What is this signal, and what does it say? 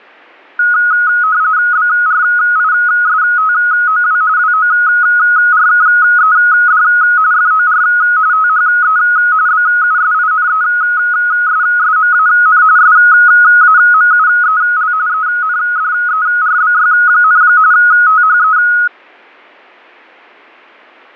RTTY (45.45 baud, 170 Hz shift), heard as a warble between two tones, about 1360 Hz centre. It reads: BRISTOW WORKED FOR THE BUSINESSMAN SAMUEL ENDERBY, THE